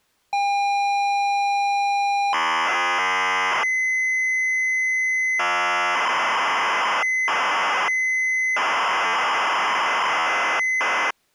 ZX Spectrum tape loading, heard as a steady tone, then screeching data.